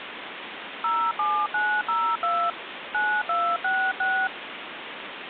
DTMF, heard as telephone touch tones, dialled by hand, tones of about 270 ms, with phone line noise. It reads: 07902 9266